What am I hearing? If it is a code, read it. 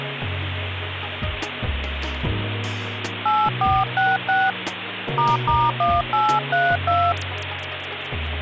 DTMF, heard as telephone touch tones, dialled by hand, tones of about 220 ms, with phone line noise. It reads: 8466 **1832